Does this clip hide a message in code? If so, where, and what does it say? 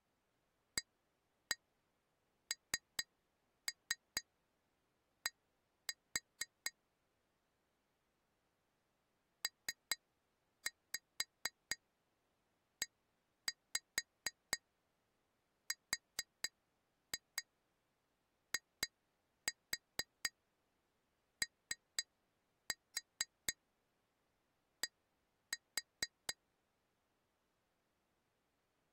Yes: tap code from 0.8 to 26.4 s, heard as taps on glass, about 4 knocks a second. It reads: AND PERIOD